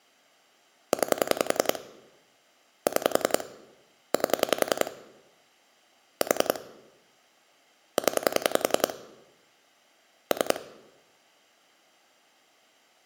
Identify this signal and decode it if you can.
Pulse dialling, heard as clicks on a phone line, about 10 pulses a second. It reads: 9 6 8 4 0 3